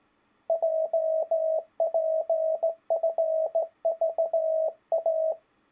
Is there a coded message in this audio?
Yes: Morse code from 0.4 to 5.4 s, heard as a keyed tone, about 17 wpm, 640 Hz. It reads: JPFVA